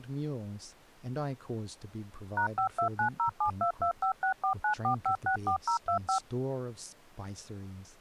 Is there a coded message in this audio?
Yes: DTMF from 2.4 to 6.2 s, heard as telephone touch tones, dialled by machine, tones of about 100 ms, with speech in English. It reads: #529072256494564025